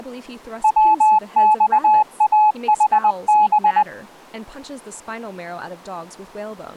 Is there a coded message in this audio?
Yes: Morse code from 0.6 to 3.9 s, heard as a keyed tone, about 20 wpm, 850 Hz, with speech in English. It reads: WXAHB